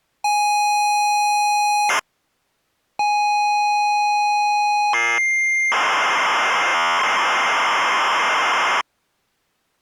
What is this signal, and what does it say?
ZX Spectrum tape loading, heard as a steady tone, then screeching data.